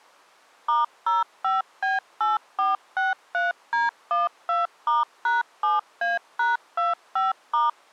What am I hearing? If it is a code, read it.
DTMF, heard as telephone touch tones, dialled by machine, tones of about 160 ms. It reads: *05B8463D12*#7A#25*